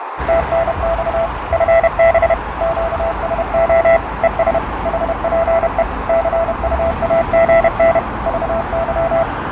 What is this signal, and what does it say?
Morse code, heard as a keyed tone, machine-sent, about 31 wpm, 660 Hz, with radio static, fading, a narrow filter and street noise. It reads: TNX FB QSO ES HPE CUAGN VY